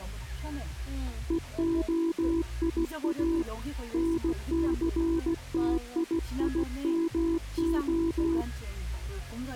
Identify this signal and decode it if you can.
Morse code (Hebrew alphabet), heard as a keyed tone, hand-sent with a paddle, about 16 wpm, 330 Hz, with the noise inside a car. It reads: והיא נסתיימה